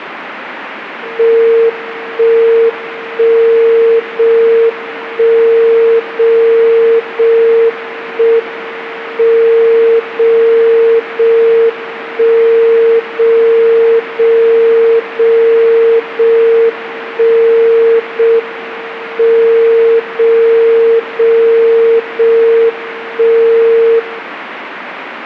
Radio time signal (JJY), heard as a tone whose level steps once a second, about 460 Hz, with radio static. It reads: 1 1 0 1 0 0 1 M 0 0 1 0 0 0 0 1 0 M 0 0 0 1 0